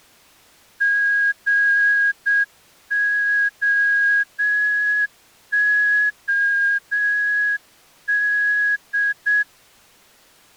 Morse code, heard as a whistle, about 7 wpm. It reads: GOOD